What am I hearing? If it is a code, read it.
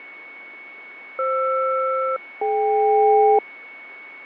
Aircraft SELCAL, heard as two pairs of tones, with a steady whistle near 2220 Hz. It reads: FR-DK